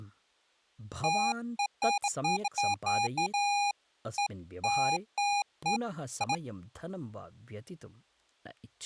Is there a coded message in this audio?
No, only beeps of irregular length, with speech in Sanskrit.